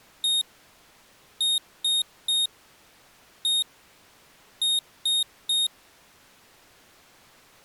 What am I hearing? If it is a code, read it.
Beep code, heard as a piezo beeper, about 3700 Hz. 1-3-1-3. In Phoenix BIOS tables: keyboard controller test failure.